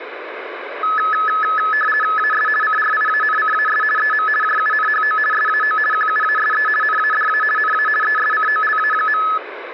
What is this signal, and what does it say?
RTTY (50 baud, 450 Hz shift), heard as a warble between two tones, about 1500 Hz centre, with radio static. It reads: AS CRIANCAS EM JUNHO SAO QUASE NADA NA ESCOLA.